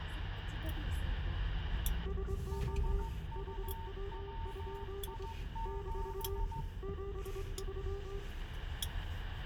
Morse code, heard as two keyed tones, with radio static, room echo and the noise inside a car. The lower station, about 24 wpm, 400 Hz: SO HW? - 73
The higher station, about 15 wpm, 900 Hz: HUWI7